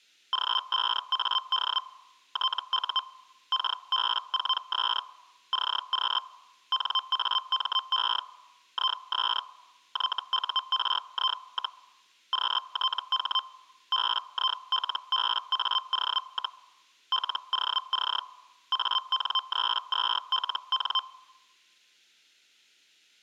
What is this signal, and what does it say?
Hellschreiber (Feld-Hell, 122.5 baud), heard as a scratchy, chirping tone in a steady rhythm, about 1040 Hz. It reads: G5AD TU KB4S CQ NAME IS YURI, QTH BILBAO, LOC AN32LN